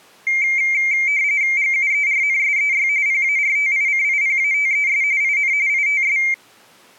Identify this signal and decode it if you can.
RTTY (45.45 baud, 170 Hz shift), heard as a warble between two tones, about 2200 Hz centre. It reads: GUERNSEY PARTICIPATES IN ITS